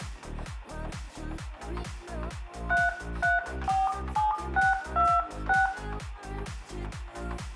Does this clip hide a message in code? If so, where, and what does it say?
Yes: DTMF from 2.7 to 5.7 s, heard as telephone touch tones, dialled by hand, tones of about 200 ms, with room echo. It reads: 3347626